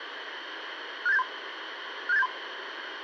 Five-tone selective call (EIA), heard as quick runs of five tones, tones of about 30 ms, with radio hiss and room echo. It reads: 67873 67873